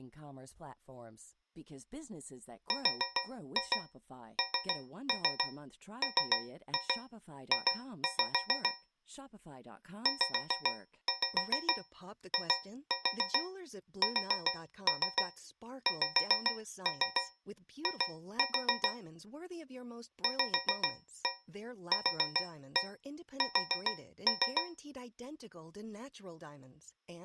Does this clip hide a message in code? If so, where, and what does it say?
Yes: tap code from 2.7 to 24.8 s, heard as taps on a metal pipe, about 7 knocks a second, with speech in Swedish. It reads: RNMJ ZISXI VQS